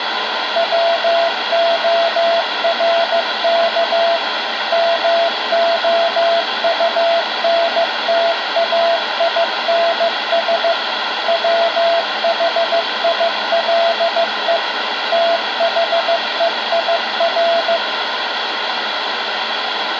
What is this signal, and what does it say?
Morse code, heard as a keyed tone, machine-sent, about 15 wpm, 680 Hz, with radio static and room echo. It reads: WORK MOUNTAINS WHILE THEIR